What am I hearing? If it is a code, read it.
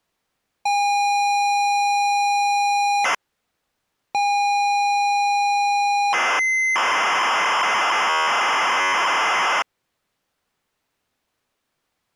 ZX Spectrum tape loading, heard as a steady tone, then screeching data.